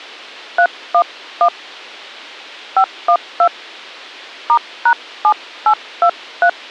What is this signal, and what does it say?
DTMF, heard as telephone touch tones, dialled by hand, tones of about 80 ms. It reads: 311 512 *#7823